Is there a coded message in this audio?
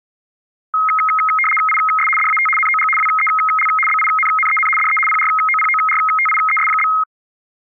Yes: RTTY (75 baud, 850 Hz shift) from 0.7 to 7.0 s, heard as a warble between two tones, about 1700 Hz centre. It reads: IS DAT NOG WEL BINNEN DE PROPORTIES?